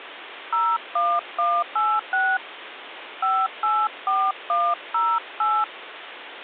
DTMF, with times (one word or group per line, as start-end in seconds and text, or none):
0.5-2.4 01186
3.2-5.6 584108